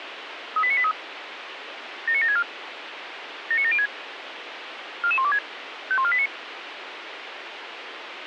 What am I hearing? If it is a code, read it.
Five-tone selective call (ZVEI), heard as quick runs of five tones, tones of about 70 ms, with radio hiss. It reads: 38983 79764 79706 44126 51489